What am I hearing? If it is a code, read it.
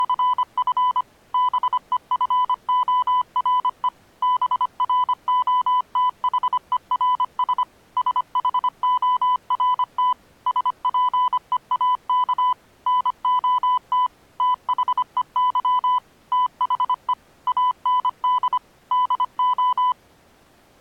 Morse code, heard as a keyed tone, machine-sent, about 25 wpm, 1000 Hz. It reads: … BEFORE BROTHERS SHORT SPEAK NOT THEY THE AND DO